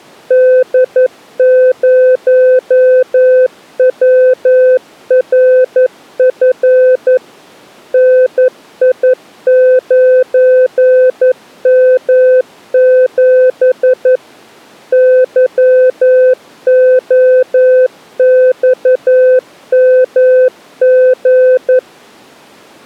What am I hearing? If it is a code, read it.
Morse code, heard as a keyed tone, machine-sent, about 11 wpm, 510 Hz. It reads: D0WRF NI9M7 YOXMG